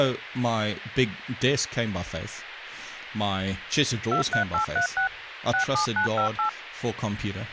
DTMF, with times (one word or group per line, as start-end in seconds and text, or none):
4.1-5.1 23836
5.5-6.5 67958